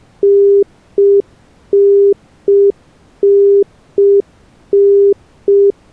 Telephone call progress tone (UK plan), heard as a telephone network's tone, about 400 Hz. Congestion tone.